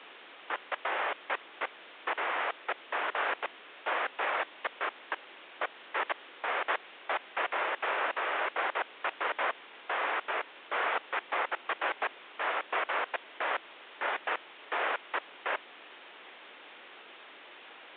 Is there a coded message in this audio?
No, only bursts of noise, with phone line noise.